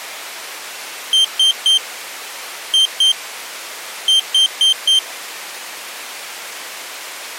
Beep code, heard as a piezo beeper, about 3150 Hz. 3-2-4. In Phoenix BIOS tables: keyboard controller failure.